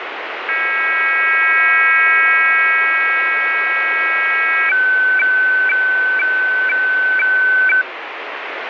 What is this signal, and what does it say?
Weather fax (radiofax), 120 lines a minute, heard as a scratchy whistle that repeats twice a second, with radio static.